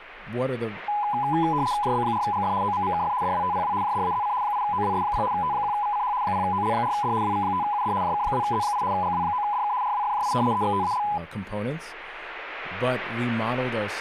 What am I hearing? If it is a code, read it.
RTTY (75 baud, 170 Hz shift), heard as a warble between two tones, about 920 Hz centre, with speech in English. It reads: JB4GF OMMKF DWTPW JDAZC 8OWS0 T1VCH 0OL4D WV5UD JK2Z8 GW9DK RWFJI EXTAL